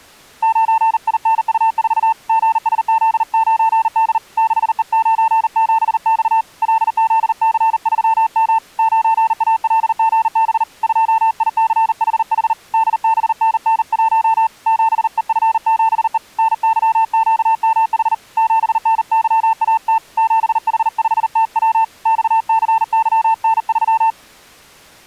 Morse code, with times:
0.4-2.1 9INU4
2.3-4.2 GSZ9D
4.4-6.4 6E97X
6.6-8.6 LZC3M
8.8-10.6 9ALGB
10.8-12.5 2ICHH
12.7-14.5 DBNN1
14.7-16.2 7EF7E
16.4-18.1 NYQMH
18.4-20.0 7NYAT
20.2-21.8 7H5TW
22.1-24.1 XCYN3

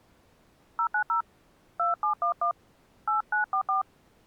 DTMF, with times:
0.8-1.2 090
1.8-2.5 2711
3.1-3.8 8944

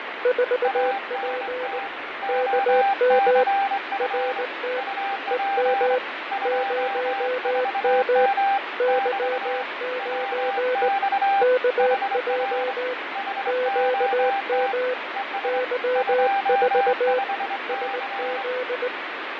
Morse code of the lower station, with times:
0.3-1.8 4P
2.3-3.4 KM
4.0-4.8 RT
5.3-6.0 EM
6.5-8.3 0M
8.8-10.9 Y9
11.4-12.9 KJ
13.5-14.9 QM
15.4-17.2 Y4
17.7-18.9 SZ

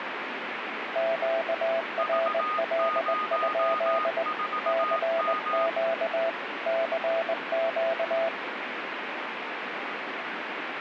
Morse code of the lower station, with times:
1.0-4.2 QRL?
4.7-6.3 CQ
6.7-8.3 CQ

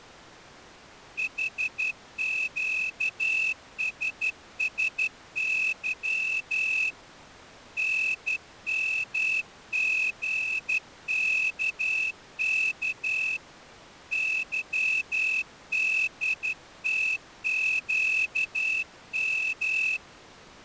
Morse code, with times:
1.2-6.9 HQSSY
7.8-13.4 NMGKK
14.1-20.0 YDTQM

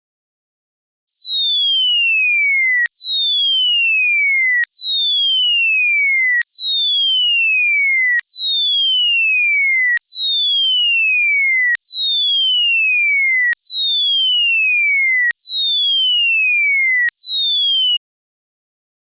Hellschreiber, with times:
none

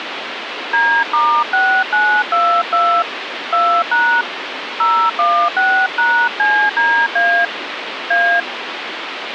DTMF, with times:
0.7-3.0 D*6922
3.5-4.2 2#
4.8-7.5 016#CDA
8.1-8.4 A

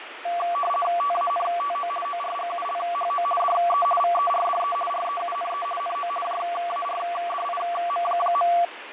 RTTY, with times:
1.0-1.9 TANTO
2.0-3.2 ORGULHO
3.4-3.9 DE
4.0-4.8 VERDE
4.9-5.7 REUNE
5.8-6.1 NO
6.2-8.5 JARDIM.

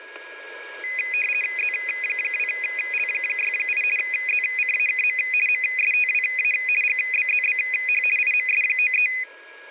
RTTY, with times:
1.6-3.8 Z2L68
4.0-5.2 ZCAKM
5.5-6.5 MSTWA
6.8-8.0 GBZBH
8.2-9.1 IMS93

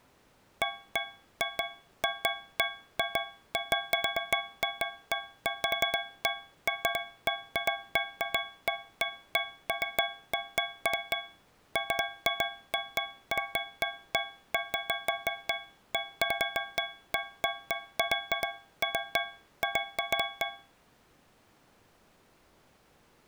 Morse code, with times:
none

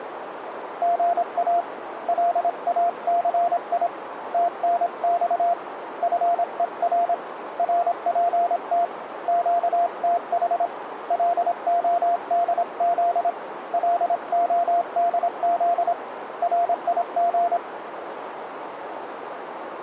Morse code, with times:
0.8-1.6 GA
2.1-3.9 LACI
4.3-5.5 TNX
6.0-7.1 FER
7.6-8.8 RPT
9.3-10.7 QTH
11.1-13.3 LODZ
13.7-15.9 LODZ
16.4-17.6 RIG

